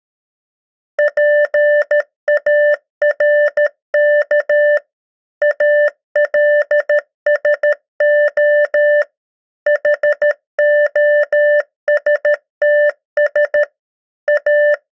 Morse code, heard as a keyed tone, machine-sent, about 13 wpm, 590 Hz. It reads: PARK ALSO HOSTS A